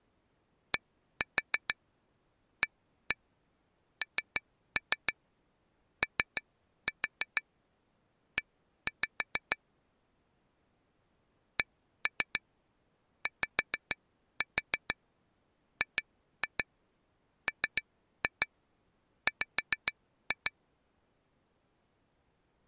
Tap code, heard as taps on glass, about 6 knocks a second. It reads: DANOE CYGMW